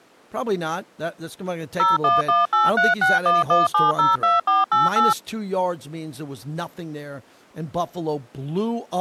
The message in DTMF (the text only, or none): 01183611702488